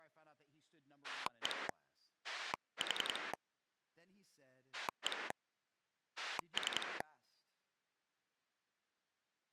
Pulse dialling, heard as a rotary dial, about 10 pulses a second, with speech in English. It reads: 1 4 1 3